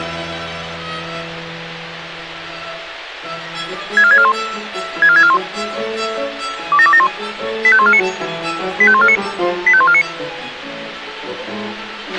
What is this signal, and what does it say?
Five-tone selective call (ZVEI), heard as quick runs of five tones, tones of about 70 ms, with radio hiss and a squelch burst at the end. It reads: 64641 64641 27271 85149 85149 85149